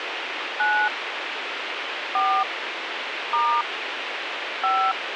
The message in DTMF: 9 4 * 5

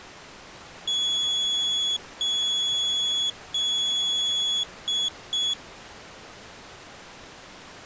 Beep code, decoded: 3 long, 2 short

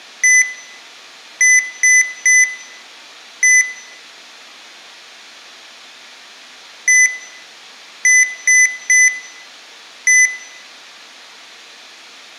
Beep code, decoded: 1-3-1

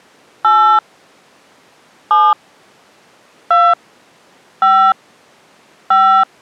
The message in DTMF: 8 7 2 5 5

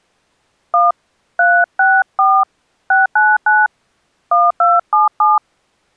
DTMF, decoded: 1 364 699 1277

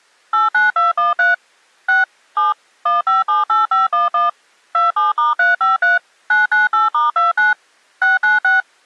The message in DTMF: 89213 6 7 1578511 27*353 998*29 696

